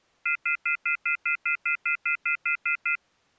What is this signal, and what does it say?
Telephone call progress tone (North American plan), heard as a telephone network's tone, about 1400, 2050, 2450, 2600 Hz, 0.1 s on and 0.1 s off. Off-hook warning tone.